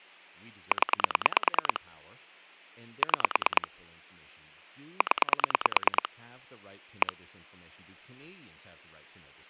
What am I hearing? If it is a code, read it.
Pulse dialling, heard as clicks on a phone line, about 9 pulses a second, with speech in English. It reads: 0 6 0 1